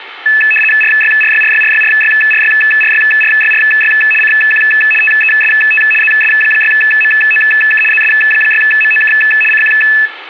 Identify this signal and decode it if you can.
RTTY (75 baud, 850 Hz shift), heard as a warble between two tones, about 2150 Hz centre, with radio static and room echo. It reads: RYRYRYRYRYRYRYRYRY CQ TEST ZS6MOK ZS6MOK CQ